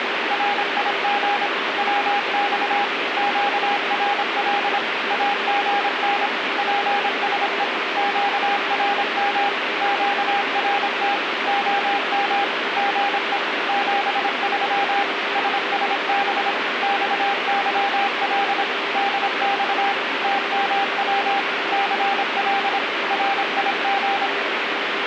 Morse code, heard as a keyed tone, machine-sent, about 26 wpm, 800 Hz, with radio static. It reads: RIG WX QRL AGN PSE QRM QRT OM GE 73 SSB XYL DX TMW CL RIG